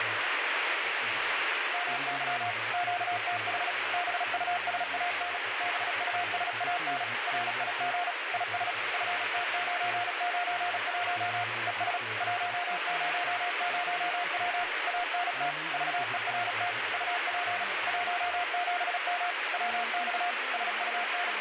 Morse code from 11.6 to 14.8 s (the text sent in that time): ES 100W